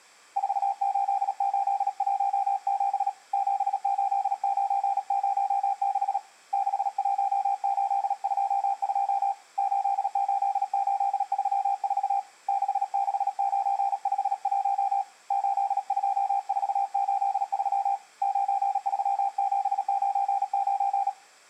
Morse code, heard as a keyed tone, hand-sent with a paddle, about 37 wpm, 790 Hz. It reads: 48817 78906 61822 88834 66951 82483 93799